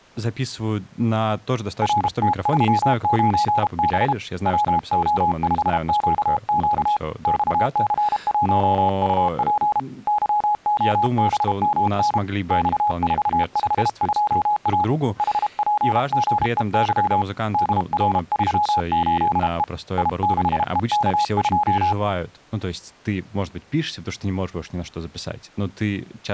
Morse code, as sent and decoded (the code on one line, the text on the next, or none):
.-. - ...-- ----. -... / .-- --- ..... --.- --.- / -..- -.-. .---- ..- .--. / -.-- --- -... -- -. / -..- ....- ..... ..--- .- / .... .--. --. . -.-- / -.. .-. ...-- ---.. . / .. -.... . -.- ..---
RT39B WO5QQ XC1UP YOBMN X452A HPGEY DR38E I6EK2